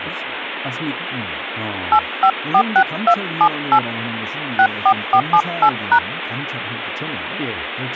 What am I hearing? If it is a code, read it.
DTMF, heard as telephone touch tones, dialled by hand, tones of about 70 ms, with phone line noise and speech in Korean. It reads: 8546278 64478#